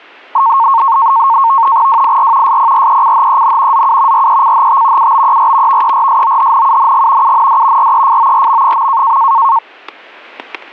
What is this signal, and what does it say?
NAVTEX (SITOR-B), 100 baud, 170 Hz shift, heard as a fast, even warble, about 1000 Hz centre, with static crashes. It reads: WIR SPRECHEN ZU RECHT UBER VERSOHNUNG UND REFORM.